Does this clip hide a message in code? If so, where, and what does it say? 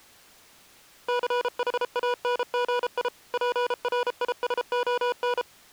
Yes: Morse code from 1.0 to 5.5 s, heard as electronic beeps, machine-sent, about 33 wpm, 490 Hz. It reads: CHANGI PRISON